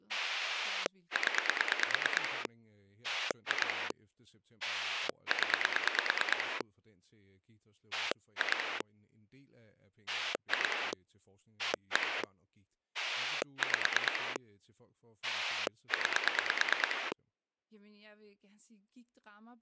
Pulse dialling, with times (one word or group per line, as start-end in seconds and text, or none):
0.1-2.5 0
3.0-3.9 2
4.6-6.6 0
7.9-8.8 2
10.1-10.9 2
11.6-12.2 1
12.9-14.4 5
15.2-17.1 9